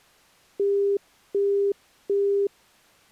Telephone call progress tone (as in the UK, Australia and similar networks), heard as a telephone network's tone, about 400 Hz, 0.375 s on and 0.375 s off. Busy tone.